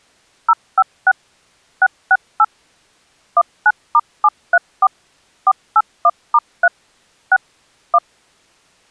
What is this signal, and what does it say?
DTMF, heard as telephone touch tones, dialled by machine, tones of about 50 ms. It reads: 056 668 19*734 481*3 6 1